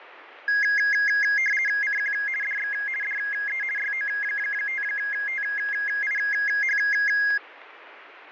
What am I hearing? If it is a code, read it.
RTTY (50 baud, 450 Hz shift), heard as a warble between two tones, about 1900 Hz centre, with radio static. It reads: CQ DX DE YO5TIH